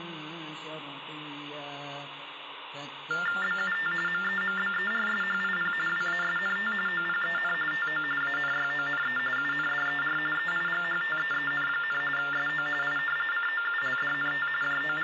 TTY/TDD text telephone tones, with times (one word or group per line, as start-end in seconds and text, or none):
3.4-3.9 BUT
4.1-5.7 MEMBERSHIP
5.9-6.7 WASNT
6.9-7.5 OPEN
7.7-8.0 TO
8.2-9.2 ANYONE
9.4-10.2 UNDER
10.4-12.0 EIGHTEEN,
12.2-12.7 SO
12.8-13.0 I
13.3-14.5 COULDNT
14.6-15.0 …